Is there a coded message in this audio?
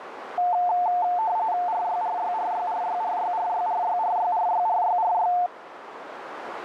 Yes: RTTY (45.45 baud, 170 Hz shift) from 0.4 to 5.5 s, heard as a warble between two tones, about 800 Hz centre, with radio static and a narrow filter. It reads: RYRYRYRYRYRYRYRYRYRYRY